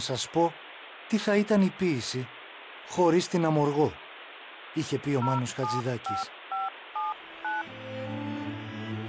DTMF, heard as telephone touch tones, dialled by hand, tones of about 170 ms, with phone line noise. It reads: 075579